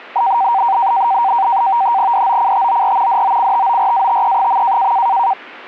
NAVTEX (SITOR-B), 100 baud, 170 Hz shift, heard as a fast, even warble, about 860 Hz centre. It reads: DOCTOR DOCTORATE.